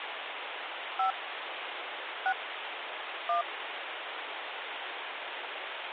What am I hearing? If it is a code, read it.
DTMF, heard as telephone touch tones, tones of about 90 ms, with phone line noise. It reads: 5 6 1